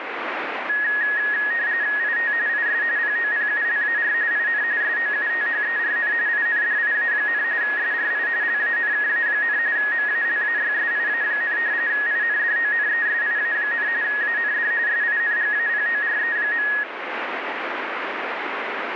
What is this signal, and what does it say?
RTTY (45.45 baud, 170 Hz shift), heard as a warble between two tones, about 1800 Hz centre, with radio static. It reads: IT IS POPULAR IN SOUTHERN INDIA, SRI LANKA, MALAYSIA, INDONESIA, AND SINGAPORE.